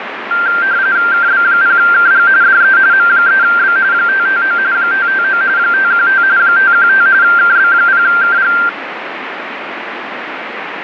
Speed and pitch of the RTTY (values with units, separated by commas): 45.45 baud, 170 Hz shift, 1480 Hz centre